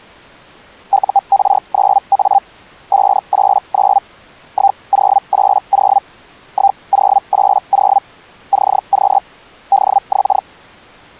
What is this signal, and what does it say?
Hellschreiber (Feld-Hell, 122.5 baud), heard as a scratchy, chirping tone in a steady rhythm, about 790 Hz. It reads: UR9A 589 1080 1080 CQ DX